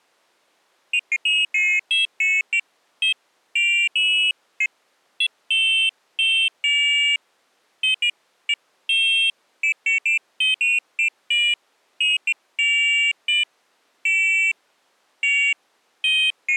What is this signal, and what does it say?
Pairs of high tones at irregular times. There is no code.